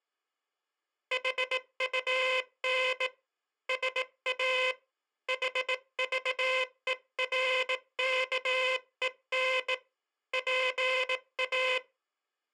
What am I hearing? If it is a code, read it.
Morse code, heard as a buzzer, hand-sent with a bug key, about 18 wpm. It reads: HUN SA HVERKEN PA